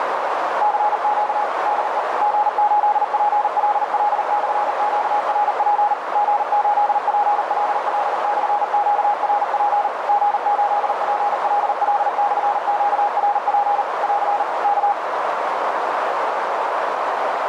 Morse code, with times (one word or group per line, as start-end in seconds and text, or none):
0.6-1.4 CQ
1.7-2.0 DE
2.2-5.9 G8PLL/QRP
6.2-9.9 G8PLL/QRP
10.1-13.8 G8PLL/QRP
14.0-14.4 <AR>
14.6-14.9 K